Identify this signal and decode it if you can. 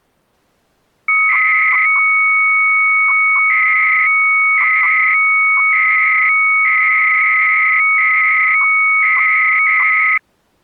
300-baud modem data (Bell 103 tones), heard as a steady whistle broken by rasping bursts, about 300 baud, 200 Hz shift.